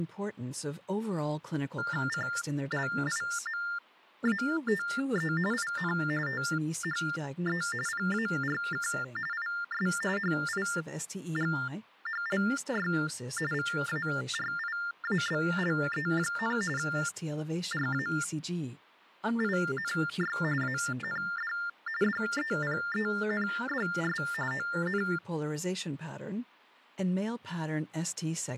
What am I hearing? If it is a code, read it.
TTY/TDD text telephone tones (45.45 baud Baudot), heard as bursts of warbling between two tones, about 400 Hz shift, 1600 Hz centre. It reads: CLIMATE IN THE PARK IS HIGHLY VARIABLE, RAINY AND DEPENDS ON